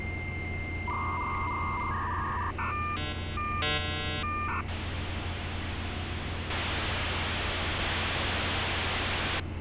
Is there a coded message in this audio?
Yes: dial-up modem handshake (V.34 or later) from 0.0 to 9.4 s, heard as a whistle, warbles, then hiss, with street noise.